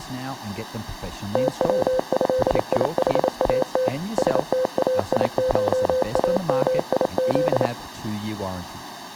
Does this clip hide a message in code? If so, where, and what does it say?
Yes: Morse code (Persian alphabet) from 1.3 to 7.7 s, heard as a keyed tone, machine-sent, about 28 wpm, 510 Hz, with speech in English. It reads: توضیحات ستایشامیز